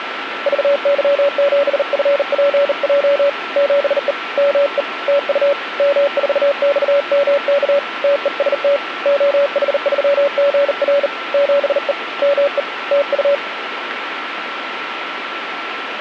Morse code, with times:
0.5-3.3 VY7FPJ
3.6-4.1 7E
4.4-4.8 ME
5.1-5.5 TU
5.8-7.8 M4XMK
8.0-8.8 TEST
9.1-11.1 OH3GR
11.3-11.9 7E
12.2-12.6 ME
12.9-13.3 TU

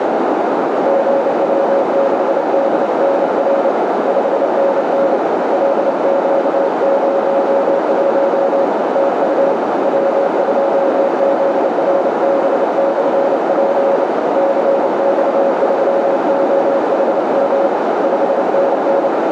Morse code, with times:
0.9-3.7 GW6DNR
4.1-5.2 5NN
5.5-8.7 LQ01
9.0-9.5 TU
9.8-14.0 W2ZRB/P
14.4-17.7 CX3OHM
18.0-19.1 5NN

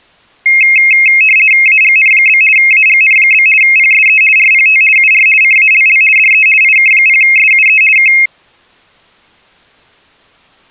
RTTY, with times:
1.7-2.4 AGN?
2.6-3.5 AGN?
3.6-4.2 PSE
4.4-4.8 RPT
5.0-5.3 UR
5.4-6.0 CALL
6.2-6.5 DE
6.6-7.8 IK0SUE
8.0-8.1 K

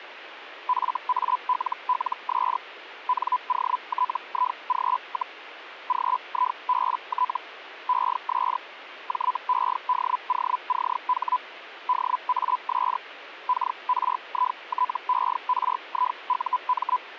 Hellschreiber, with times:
0.7-2.6 FALLS
3.1-5.4 NOTIG,
5.9-7.4 GIBT
7.9-8.6 ES
9.1-11.4 JEDOCH
11.9-13.0 DAS
13.5-17.0 KRITERIUM

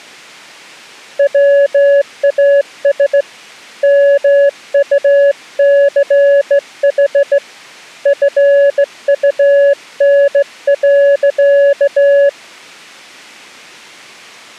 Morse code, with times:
1.2-3.2 WAS
3.8-7.4 MUCH
8.1-12.3 FUN.

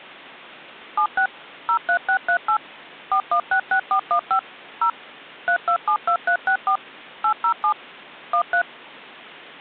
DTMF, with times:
1.0-1.3 76
1.7-2.6 03638
3.1-4.4 4166415
4.8-4.9 0
5.5-6.8 3272364
7.2-7.7 807
8.3-8.6 13

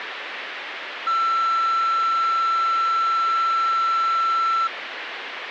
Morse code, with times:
none

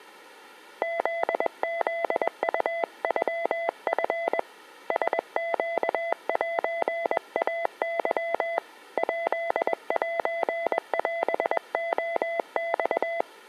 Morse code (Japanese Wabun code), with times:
0.8-4.4 フフウノチ
4.9-8.6 ラネセイケ
9.0-13.2 ヱセオレマ

